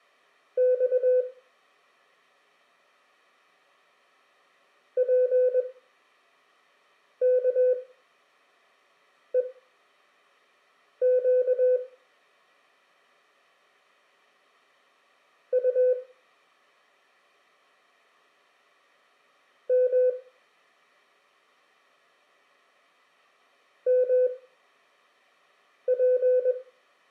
Morse code, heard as a keyed tone, machine-sent, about 21 wpm, spaced as for 5 wpm, 500 Hz, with room echo. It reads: X PKEQ U M MP